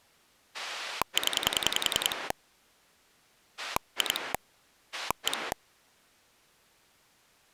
Pulse dialling, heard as a rotary dial, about 10 pulses a second. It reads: 0 2 1